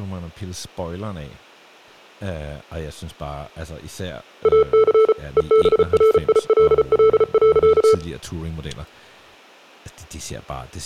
Morse code, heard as electronic beeps, machine-sent, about 34 wpm, 440 Hz, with speech in Danish. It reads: AC EBRILL.